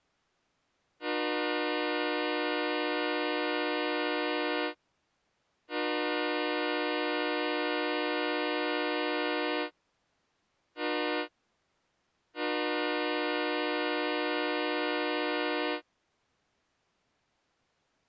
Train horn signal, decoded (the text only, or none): 2 long, 1 short, 1 long